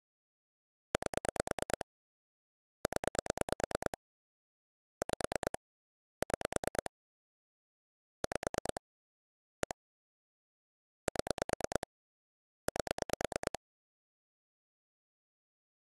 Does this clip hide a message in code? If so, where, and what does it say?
Yes: pulse dialling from 0.9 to 13.6 s, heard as clicks on a phone line, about 9 pulses a second. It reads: 8 0 5 6 5 1 7 8